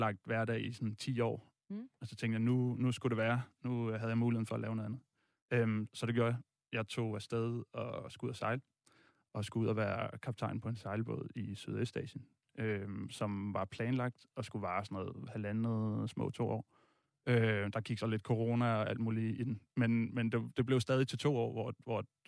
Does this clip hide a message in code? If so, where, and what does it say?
No, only speech in Danish.